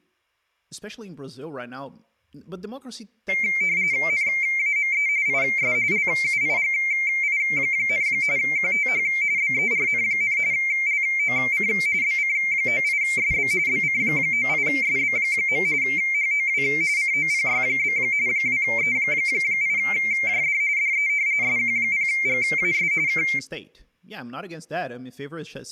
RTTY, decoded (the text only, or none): NAME IS LUIGI, QTH BERN, LOC BC98SB BC98SB. HOW COPY? 2E8JD DE SQ0GAS K